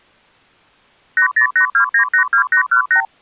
Multi-frequency trunk signalling (R2, with the far end's replies), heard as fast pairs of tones, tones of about 100 ms. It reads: 8082982818